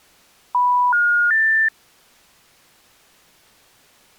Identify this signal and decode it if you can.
Telephone call progress tone (North American plan), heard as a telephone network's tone, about 980, 1430, 1800 Hz. Special information tone.